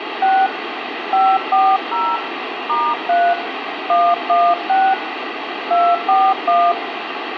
DTMF, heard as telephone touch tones, dialled by hand, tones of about 240 ms, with phone line noise and room echo. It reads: 6 540 *3 116 241